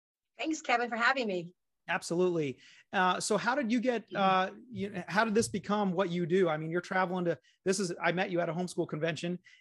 Speech in English. There is no code.